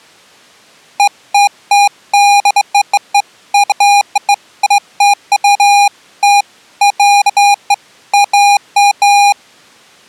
Beeps of irregular length. There is no code.